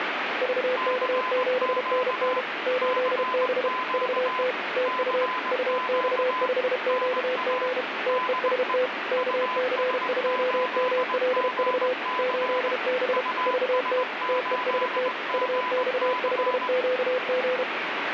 Morse code, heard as two keyed tones, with radio static. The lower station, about 32 wpm, 510 Hz: VK7NN 8B VT TU UX5QG TEST KC2MLV 8B VT TEST UX5QG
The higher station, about 20 wpm, 1010 Hz: CQ CQ CQ NA DE US8GC US8GC